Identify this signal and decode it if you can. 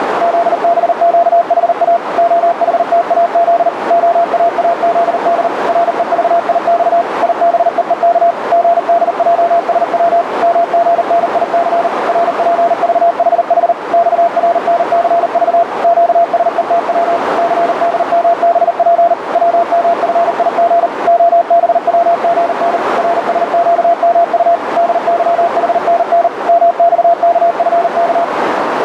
Morse code, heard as a keyed tone, machine-sent, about 39 wpm, 680 Hz, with radio static and a narrow filter. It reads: ZBQHA OHTAZ OAAZD REVIX IBEEK GDJSW MGNIC RPVHH XRNCV QSETW CDMBP WMFIG OBWGN RSQMU DYHNN MXKFK